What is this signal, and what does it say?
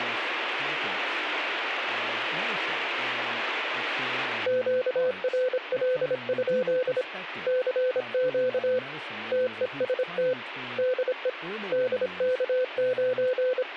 Morse code, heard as a keyed tone, hand-sent with a paddle, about 26 wpm, 510 Hz, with speech in English. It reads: QRL? CQ TEST DE …